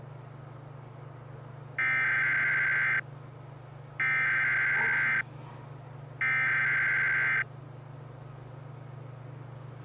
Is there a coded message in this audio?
Yes: Emergency Alert System (SAME) tones (header bursts) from 1.8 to 7.4 s, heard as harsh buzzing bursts, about 520.83 baud, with the noise inside a lift.